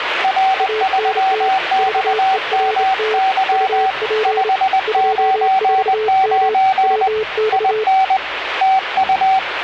Morse code, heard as two keyed tones, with radio static and the noise of a cafe. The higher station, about 20 wpm, 760 Hz: R3XMY 599 IN TU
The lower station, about 28 wpm, 430 Hz: ANT VERT UP 24M WX